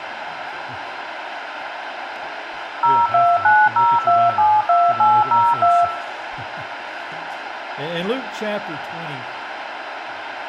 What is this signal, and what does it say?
DTMF, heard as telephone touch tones, dialled by machine, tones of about 230 ms, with radio hiss. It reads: 0290272802